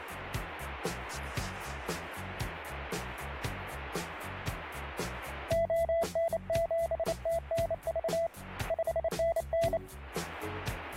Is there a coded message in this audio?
Yes: Morse code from 5.4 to 9.8 s, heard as a keyed tone, hand-sent with a bug key, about 28 wpm, 670 Hz. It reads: ON7TNV 5NN